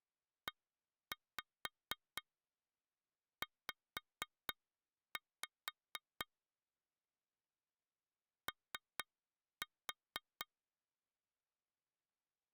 Tap code, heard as taps on glass, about 4 knocks a second. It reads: EZ O